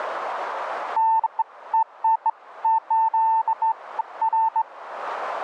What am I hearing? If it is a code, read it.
Beeps of irregular length. There is no code.